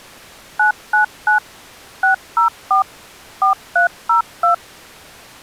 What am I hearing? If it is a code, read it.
DTMF, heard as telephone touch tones, dialled by machine, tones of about 120 ms. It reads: 999 604 4302